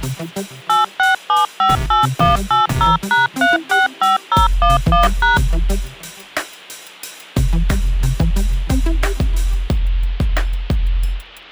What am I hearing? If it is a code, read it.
DTMF, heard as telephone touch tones, dialled by machine, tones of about 150 ms. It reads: 86758180#365011#